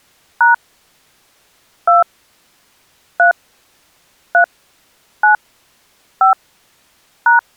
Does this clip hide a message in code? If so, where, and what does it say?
Yes: DTMF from 0.4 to 7.4 s, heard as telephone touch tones, dialled by hand, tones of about 120 ms. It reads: # 2 3 3 9 5 #